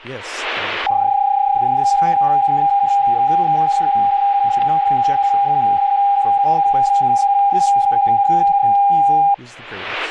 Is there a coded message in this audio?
Yes: PSK31 (31.25 baud) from 0.9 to 9.3 s, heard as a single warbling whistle, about 800 Hz, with speech in English.